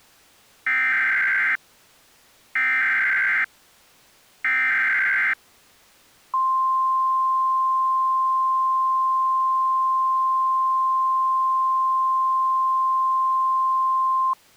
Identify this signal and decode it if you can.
Emergency Alert System (SAME) tones (header bursts, then the 1050 Hz attention tone), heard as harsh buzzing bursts, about 520.83 baud.